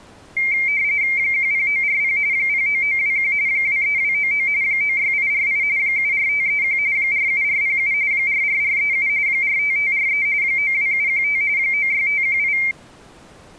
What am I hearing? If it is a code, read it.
RTTY (45.45 baud, 170 Hz shift), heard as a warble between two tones, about 2200 Hz centre. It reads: 10940 09921 23299 96848 74531 47407 44437 45543 92715 96518